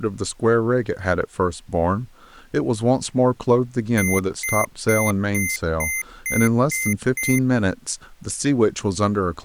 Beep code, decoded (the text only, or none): 8 short